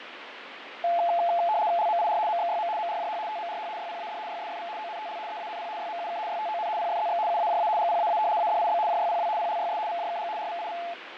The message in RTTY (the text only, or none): LMIR MXYM MRJH TMRH YPAD YSFV ONTL EANP YMUK YTON PFZX UAJA GPAA ADIB JYPW PLYS VJKG RVIV